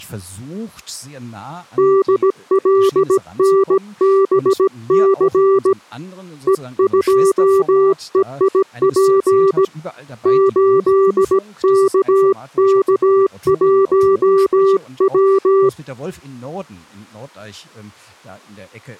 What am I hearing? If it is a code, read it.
Morse code, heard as a keyed tone, hand-sent with a paddle, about 17 wpm, 390 Hz. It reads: DLNBC E2EIP 8KK1W